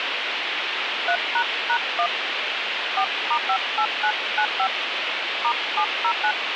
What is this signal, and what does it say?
DTMF, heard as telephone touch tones, dialled by hand, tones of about 80 ms, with phone line noise. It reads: 3##1 4*58995 *709